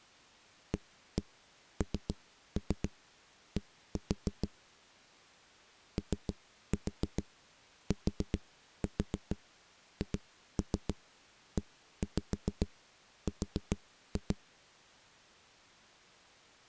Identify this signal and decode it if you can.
Tap code, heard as knocks on a wall, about 7 knocks a second. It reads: AND OTHER